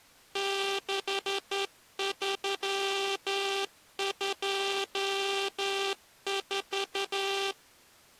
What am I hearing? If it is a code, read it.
Morse code, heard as a buzzer, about 11 wpm. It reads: 6324